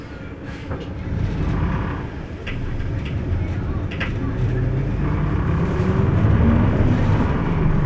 The noise inside a bus. There is no code.